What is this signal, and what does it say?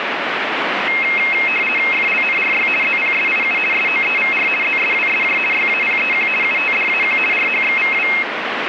RTTY (50 baud, 450 Hz shift), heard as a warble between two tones, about 2350 Hz centre, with radio static. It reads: FLNRY ZPSIU SOEVR ZSWSJ YAPEQ UTDAQ RHXVW